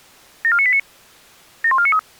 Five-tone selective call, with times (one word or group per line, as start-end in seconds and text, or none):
0.4-0.8 74989
1.6-2.0 71493